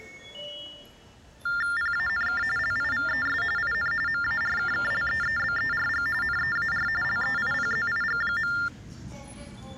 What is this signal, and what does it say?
TTY/TDD text telephone tones (45.45 baud Baudot), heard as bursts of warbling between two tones, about 400 Hz shift, 1600 Hz centre, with the noise of a subway station. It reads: PANK LIVES IN MARKKLEEBERG NEAR LEIPZIG.